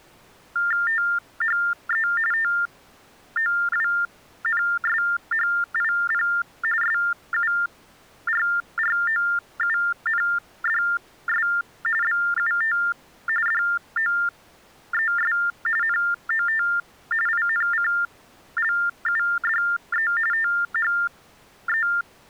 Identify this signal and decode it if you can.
TTY/TDD text telephone tones (45.45 baud Baudot), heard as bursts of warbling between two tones, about 400 Hz shift, 1600 Hz centre. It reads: THE TOWNSHIP SURROUNDS BUT DOES NOT INCLUDE THE